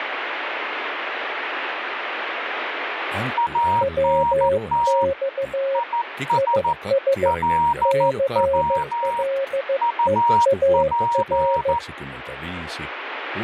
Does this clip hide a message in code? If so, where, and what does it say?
Yes: Morse code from 3.3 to 11.8 s, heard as two keyed tones, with radio static. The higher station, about 14 wpm, 940 Hz: ANT IS LW UP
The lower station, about 15 wpm, 540 Hz: WX IS CLEAR